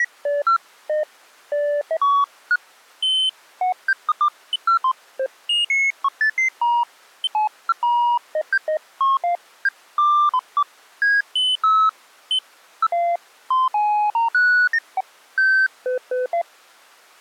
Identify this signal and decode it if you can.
Electronic bleeps of random pitch and length. There is no code.